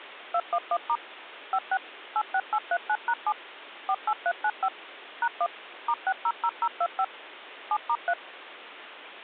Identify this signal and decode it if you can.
DTMF, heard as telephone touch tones, dialled by machine, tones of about 60 ms. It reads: 211* 56 86839#7 48395 #1 *600025 7*3